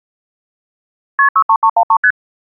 Multi-frequency trunk signalling (R1, as on North American trunks), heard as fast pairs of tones, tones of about 70 ms. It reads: KP 63313 ST